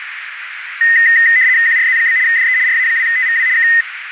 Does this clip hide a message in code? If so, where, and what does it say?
Yes: RTTY (75 baud, 170 Hz shift) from 0.8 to 3.8 s, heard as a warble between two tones, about 1950 Hz centre, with radio static and a narrow filter. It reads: QRZ? DE RA2TVW K